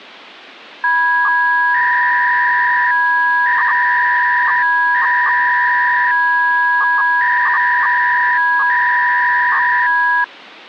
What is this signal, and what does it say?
300-baud modem data (V.21 tones), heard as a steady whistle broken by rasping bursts, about 300 baud, 200 Hz shift.